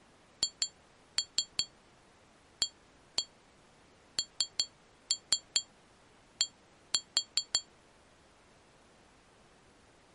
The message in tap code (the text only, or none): HAND